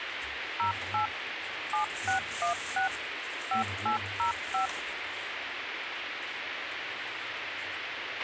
DTMF, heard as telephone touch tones, dialled by machine, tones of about 120 ms, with radio hiss, a squelch burst at the end and the noise inside a lift. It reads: 08 7616 5805